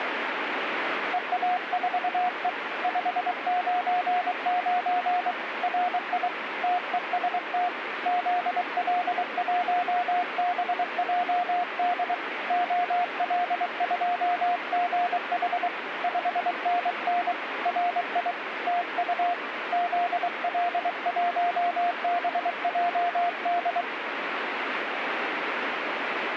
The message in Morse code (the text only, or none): EA4E 599 RI TEST ZL1BJD OL2GH 5NN RI TU ZL1BJD